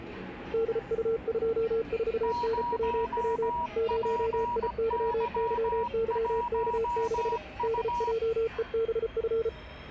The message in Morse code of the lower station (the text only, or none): DU24NWW 0IYYYK6 DJEBF